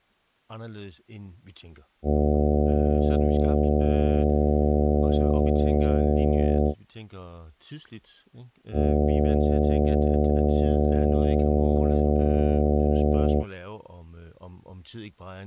Ship horn signal, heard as a ship's horn, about 70 Hz, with speech in Danish. 2 long. At sea: a vessel under power that has stopped in fog.